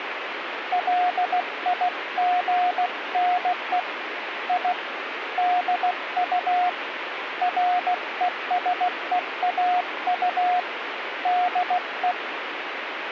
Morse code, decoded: LIGNE I DU RESEAU DE

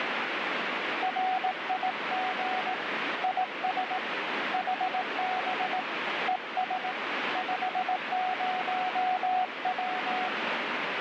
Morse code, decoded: RIG IS HB ES 50W

